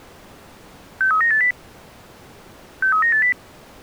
Five-tone selective call (CCIR), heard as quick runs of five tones, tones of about 100 ms. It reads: 63980 63980